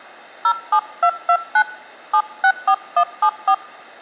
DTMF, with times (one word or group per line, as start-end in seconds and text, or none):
0.4-1.6 07229
2.1-3.5 764174